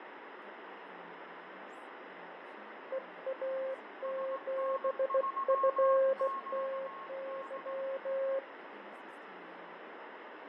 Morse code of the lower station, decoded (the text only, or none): EA7FTY